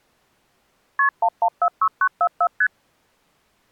Multi-frequency trunk signalling (R1, as on North American trunks), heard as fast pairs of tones, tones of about 70 ms. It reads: KP 1146944 ST